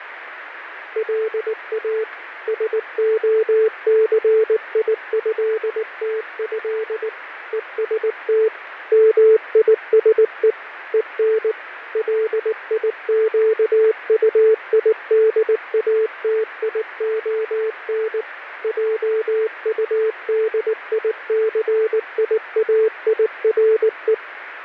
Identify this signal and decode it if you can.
Morse code (with French letters), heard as a keyed tone, machine-sent, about 19 wpm, 440 Hz, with radio static and fading. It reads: LA SOCIÉTÉ EST MISE EN LIQUIDATION JUDICIAIRE